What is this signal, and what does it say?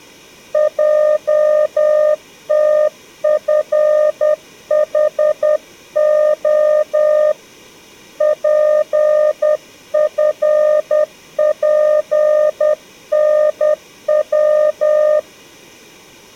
Morse code, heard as a keyed tone, hand-sent with a paddle, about 10 wpm, 610 Hz. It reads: JTFHO PFPNW